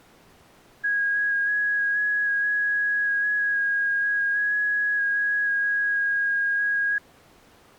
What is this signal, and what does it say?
FT8 (one signal), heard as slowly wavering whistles, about 6.25 baud.